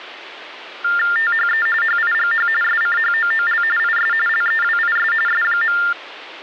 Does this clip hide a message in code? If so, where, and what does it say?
Yes: TTY/TDD text telephone tones (45.45 baud Baudot) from 0.8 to 5.9 s, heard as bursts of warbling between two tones, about 400 Hz shift, 1600 Hz centre, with phone line noise. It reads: THE HIGH SCHOOL IS LEWIS S.